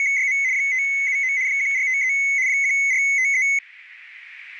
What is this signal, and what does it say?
RTTY (75 baud, 170 Hz shift), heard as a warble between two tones, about 2150 Hz centre, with radio static. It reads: … 579 1453 1453